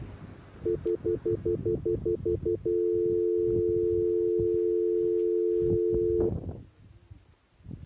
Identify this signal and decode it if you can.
Telephone call progress tone (North American plan), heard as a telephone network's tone, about 350, 440 Hz, 0.1 s on and 0.1 s off, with the noise of a residential street. Stutter dial tone.